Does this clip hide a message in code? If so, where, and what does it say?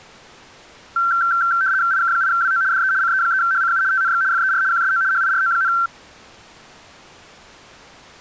Yes: RTTY (75 baud, 170 Hz shift) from 1.0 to 5.9 s, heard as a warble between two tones, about 1460 Hz centre. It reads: IK8WO DE CE3HCU TNX FER QSO HIRO,